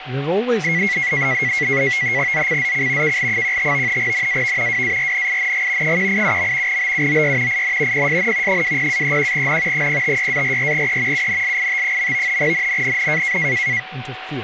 NAVTEX (SITOR-B), 100 baud, 170 Hz shift, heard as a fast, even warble, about 2050 Hz centre, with radio static, a steady whistle near 750 Hz and speech in English. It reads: ZCZC KL15 NAV WARNING 187. BUOY IN PSN 20-31N 056-44E UNLIT. NNNN